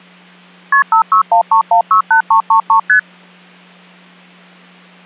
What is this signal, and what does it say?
Multi-frequency trunk signalling (R1, as on North American trunks), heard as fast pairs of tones, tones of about 100 ms, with hum. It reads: KP 5613168333 ST